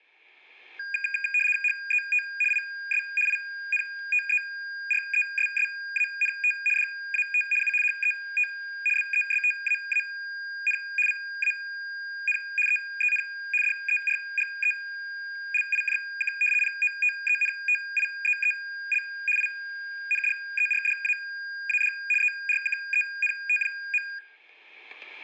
RTTY (75 baud, 850 Hz shift), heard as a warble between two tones, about 2050 Hz centre, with static crashes and room echo. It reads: HET IS INTERESSANT DAT U HET BESTAAN VAN EEN DERGELIJK POTENTIEEL INDERDAAD ERKENT.